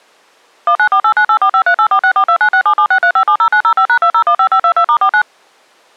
DTMF, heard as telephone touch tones, dialled by machine, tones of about 80 ms. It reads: 19489845384642967763570905#2015522*49